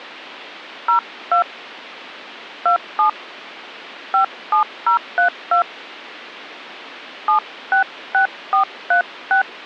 DTMF, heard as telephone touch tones, dialled by hand, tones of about 110 ms. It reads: 02 27 57032 766436